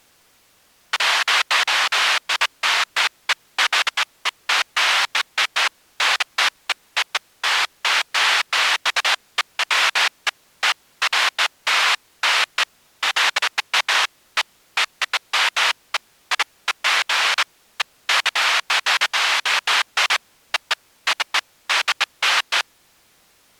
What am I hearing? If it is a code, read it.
Bursts of noise. There is no code.